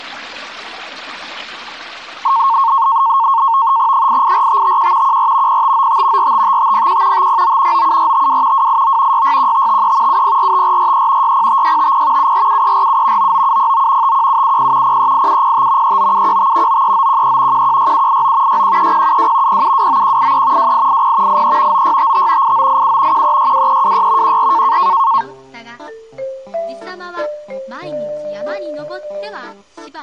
NAVTEX (SITOR-B), 100 baud, 170 Hz shift, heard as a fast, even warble, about 1000 Hz centre. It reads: 884551 14 0595 455501 509 97452 289 661553 7045443 605650 747347 99709 51770 038705 39715 93913 116789 613072 0729183 2880 83 9655 8987 1362326 14